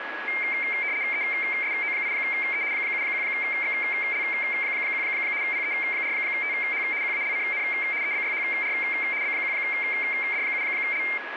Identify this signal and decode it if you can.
RTTY (75 baud, 170 Hz shift), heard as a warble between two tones, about 2200 Hz centre, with radio static and a steady whistle near 1670 Hz. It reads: ESO8E 71XL1 PE4TH QALCN EBYHR B1D7L